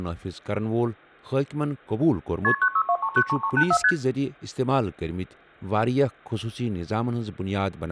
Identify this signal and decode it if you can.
Multi-frequency trunk signalling (R1, as on North American trunks), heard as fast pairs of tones, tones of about 70 ms, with speech in Kashmiri. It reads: KP 962393384 ST